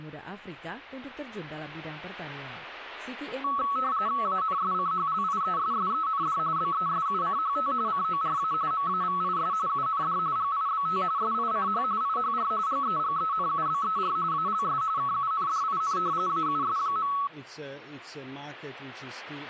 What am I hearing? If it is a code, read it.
RTTY (45.45 baud, 170 Hz shift), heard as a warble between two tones, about 1210 Hz centre. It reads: ANSCHLIESSEND BESUCHT CORA MAVIS UND GIBT SICH IHR GEGENUBER ALS KUNDIN AUS.